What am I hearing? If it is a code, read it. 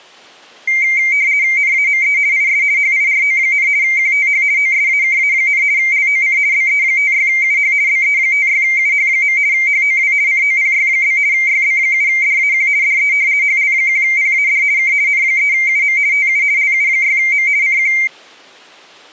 RTTY (50 baud, 170 Hz shift), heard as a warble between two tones, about 2200 Hz centre. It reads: NAME IS HIRO, QTH OSAKA, LOC BE56UH BE56UH. HOW COPY? YB7DAQ DE HL1PAD K N3UM TU LU6M CQ